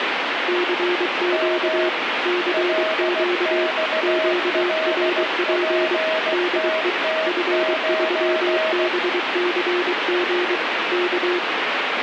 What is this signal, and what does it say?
Morse code, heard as two keyed tones, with radio static. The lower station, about 23 wpm, 360 Hz: CQ CQ QRP DE F3BCG K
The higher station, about 16 wpm, 640 Hz: M LXLPTT9